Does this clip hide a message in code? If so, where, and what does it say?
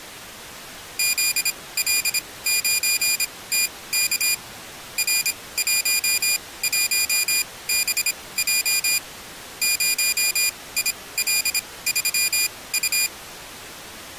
Yes: Morse code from 0.9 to 13.1 s, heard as a high beeper, machine-sent, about 26 wpm, spaced as for 19 wpm, 2450 Hz. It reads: ZL9TK R11BJ 0IL3U